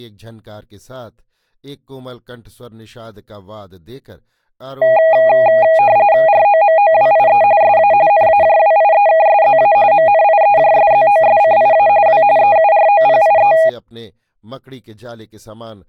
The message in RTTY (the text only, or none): ROMOWIE SA NAJWIEKSZA MNIEJSZOSCIA W EUROPIE